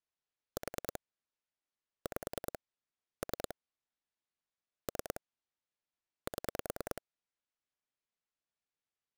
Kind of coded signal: pulse dialling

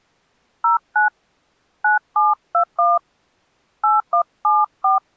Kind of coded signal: DTMF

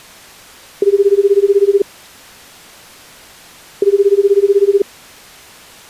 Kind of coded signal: telephone call progress tone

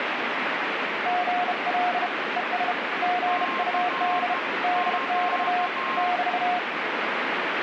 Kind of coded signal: Morse code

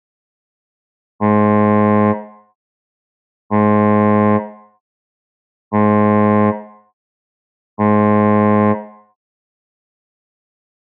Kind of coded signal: ship horn signal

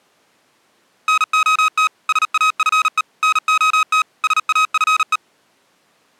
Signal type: Morse code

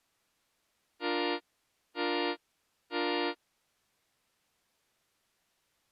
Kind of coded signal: train horn signal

